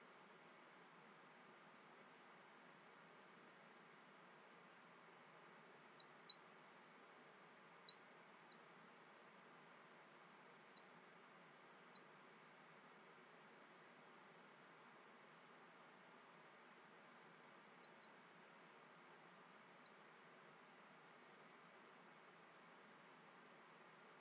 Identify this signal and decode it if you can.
Bird-like chirps. There is no code.